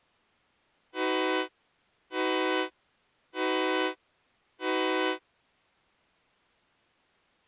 Train horn signal, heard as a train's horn. 4 short. On North American railways: a request for a signal to be given or repeated.